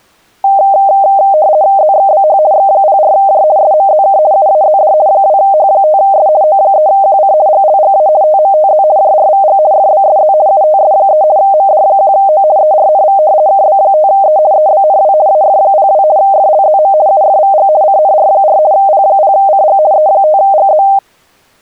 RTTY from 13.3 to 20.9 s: KB5E EBNW AF02 FLZM UFVG CNR4 P0CG E5GZ

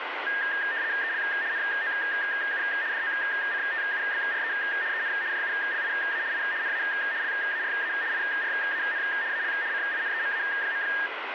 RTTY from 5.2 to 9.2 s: JULIA I NA LARA IRAN

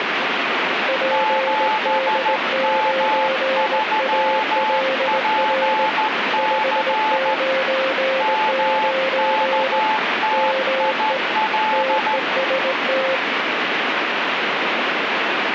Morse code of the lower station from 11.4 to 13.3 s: TEST

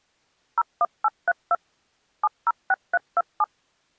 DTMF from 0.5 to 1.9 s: 01832

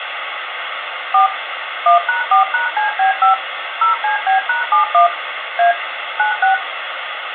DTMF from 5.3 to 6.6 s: A 96

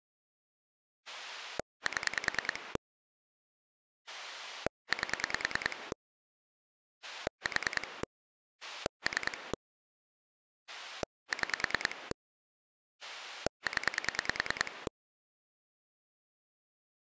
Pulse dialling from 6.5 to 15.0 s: 4 3 6 0

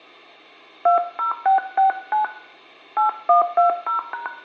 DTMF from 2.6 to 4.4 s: 8120#

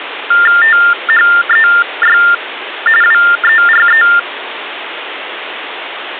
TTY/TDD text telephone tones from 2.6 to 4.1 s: WERE

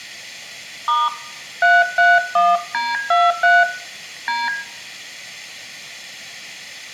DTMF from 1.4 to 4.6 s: 331D23 D

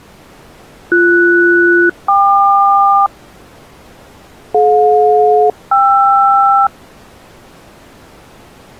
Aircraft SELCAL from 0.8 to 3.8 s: BS-KQ

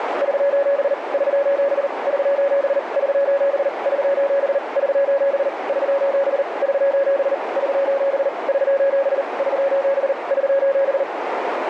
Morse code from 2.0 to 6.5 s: <SOS> <SOS> <SOS> <SOS> <SOS>

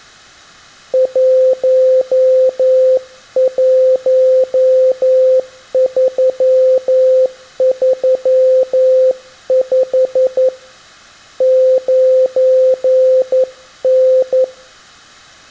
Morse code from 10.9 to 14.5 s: 9N

